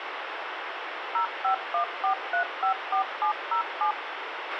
DTMF, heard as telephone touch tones, dialled by machine, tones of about 100 ms, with radio hiss and a squelch burst at the end. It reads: 0514354707